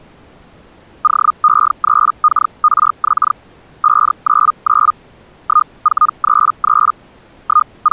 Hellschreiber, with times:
1.0-3.3 OE3KRX
3.8-4.9 599
5.4-6.9 1433
7.4-7.9 …

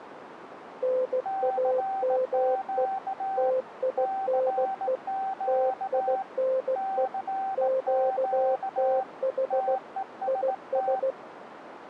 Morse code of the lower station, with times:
0.8-2.9 NAME
3.4-5.0 TINE
5.5-7.1 TINE
7.6-9.8 QTH
10.3-11.1 IS

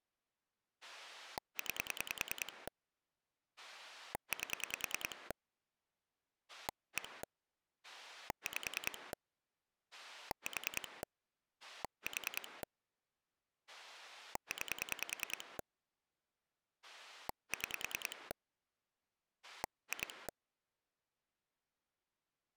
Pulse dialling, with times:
0.8-2.7 9
3.6-5.3 8
6.5-7.2 1
7.8-9.1 5
9.9-11.0 4
11.6-12.6 4
13.7-15.6 9
16.8-18.3 6
19.4-20.3 2

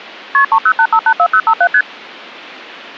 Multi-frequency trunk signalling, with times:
0.3-0.4 KP
0.5-1.7 308584057
1.7-1.8 ST

